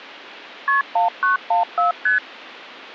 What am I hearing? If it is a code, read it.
Multi-frequency trunk signalling (R1, as on North American trunks), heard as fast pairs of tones, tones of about 130 ms. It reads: KP 1914 ST